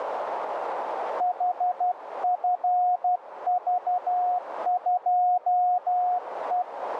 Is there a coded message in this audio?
Yes: Morse code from 1.1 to 6.7 s, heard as a keyed tone, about 12 wpm, 720 Hz, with radio static and a narrow filter. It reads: HFV2E